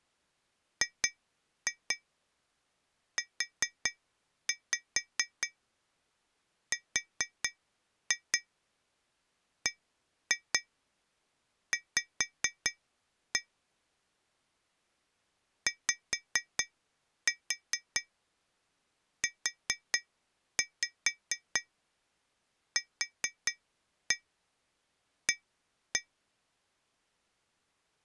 Tap code, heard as taps on glass, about 4 knocks a second. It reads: GURBV YUQA